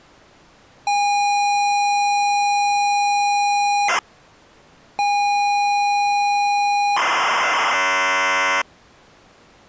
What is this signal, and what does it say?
ZX Spectrum tape loading, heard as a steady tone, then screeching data.